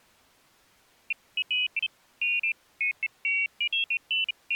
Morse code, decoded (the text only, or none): none